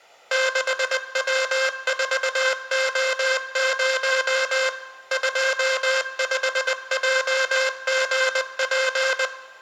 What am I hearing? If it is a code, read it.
Morse code, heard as a buzzer, machine-sent, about 20 wpm, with room echo. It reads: 6W4O0 25JGP